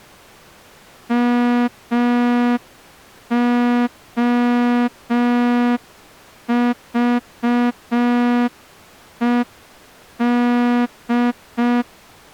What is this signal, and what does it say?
Morse code, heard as a horn, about 5 wpm. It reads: MOVED